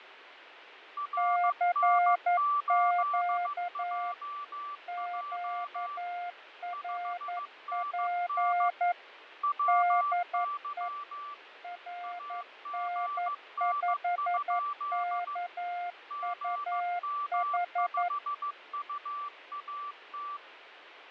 Morse code, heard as two keyed tones, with radio static and fading. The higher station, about 15 wpm, 1160 Hz: RN8JJ 5NN WY AGN? GM5UAT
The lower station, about 11 wpm, 710 Hz: CQ QRP DE RN5KUH